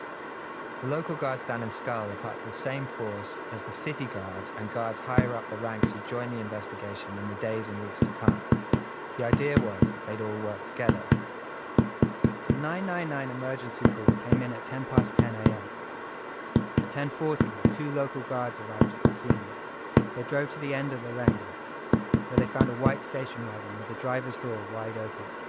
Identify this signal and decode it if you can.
Tap code, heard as knocks on a wall, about 4 knocks a second, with speech in English. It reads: A SINGLE